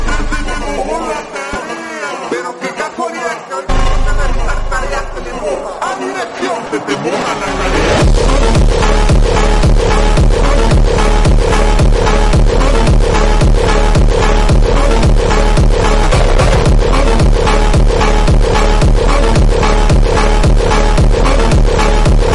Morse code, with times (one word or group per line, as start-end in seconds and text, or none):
none